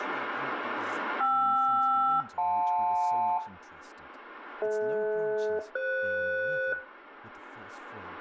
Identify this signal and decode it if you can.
Aircraft SELCAL, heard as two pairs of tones, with room echo and speech in English. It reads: KR-JL DH-FS